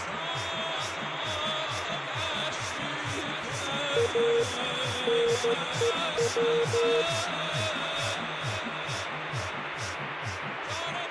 Morse code, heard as a keyed tone, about 13 wpm, 470 Hz, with radio static. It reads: A NEW